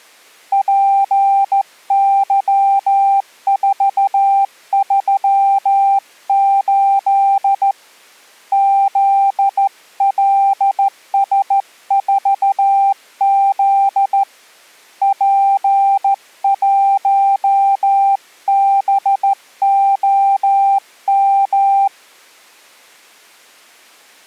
Morse code, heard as a keyed tone, hand-sent with a straight key, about 14 wpm, 790 Hz. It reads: PY438 ZLS4Z P1BOM